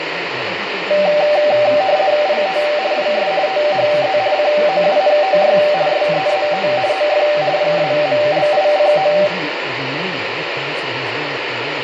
RTTY (50 baud, 170 Hz shift), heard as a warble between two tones, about 680 Hz centre, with radio static and room echo. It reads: IT IS THE COUNTY SEAT OF PAMLICO